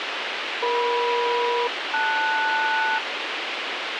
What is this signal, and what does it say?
Aircraft SELCAL, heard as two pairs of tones, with radio hiss. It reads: EM-LS